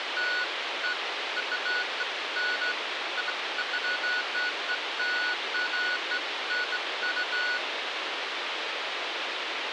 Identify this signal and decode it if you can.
Beeps of irregular length, with radio hiss. There is no code.